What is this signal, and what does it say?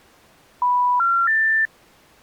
Telephone call progress tone (North American plan), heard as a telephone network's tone, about 980, 1370, 1800 Hz. Special information tone.